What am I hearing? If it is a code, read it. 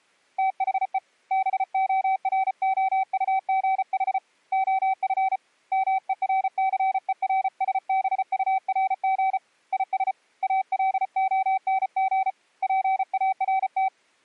Morse code, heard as a keyed tone, hand-sent with a paddle, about 34 wpm, 770 Hz. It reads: THE BOROUGH OF MERCERSBURG IS ALONG PART